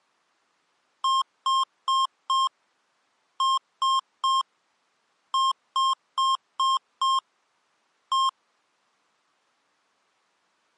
Beep code, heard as beeps from a small speaker, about 1060 Hz. 4-3-5-1.